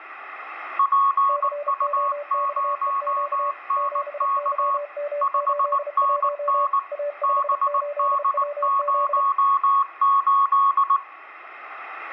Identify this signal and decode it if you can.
Morse code, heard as two keyed tones, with radio static and room echo. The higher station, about 19 wpm, 1110 Hz: PU0NK 5NN BD08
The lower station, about 32 wpm, 580 Hz: COXEQ 7YM81 A58WZ